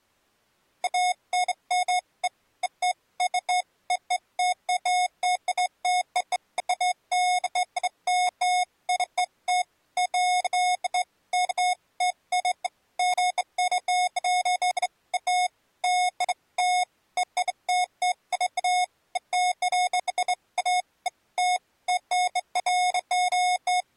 Beeps of irregular length. There is no code.